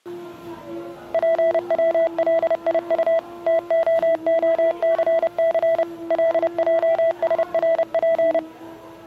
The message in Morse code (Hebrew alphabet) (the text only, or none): פצליט תההסס לעשרף